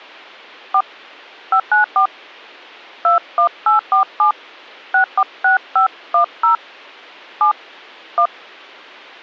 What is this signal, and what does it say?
DTMF, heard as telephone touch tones, dialled by hand, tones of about 90 ms. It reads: 4 594 21847 646510 7 1